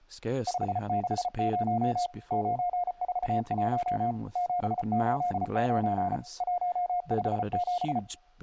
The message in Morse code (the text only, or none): 560 941 789 157